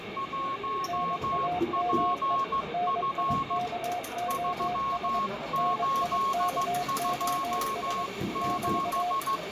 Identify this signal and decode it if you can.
Morse code, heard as two keyed tones, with radio static, room echo and the noise of a cafe. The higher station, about 15 wpm, 1090 Hz: 1PF 3827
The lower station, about 22 wpm, 720 Hz: NAME NIKOS NIKOS <BT>